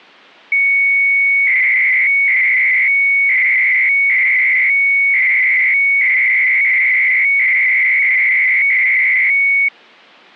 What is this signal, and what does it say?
300-baud modem data (Bell 103 tones), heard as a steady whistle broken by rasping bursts, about 300 baud, 200 Hz shift.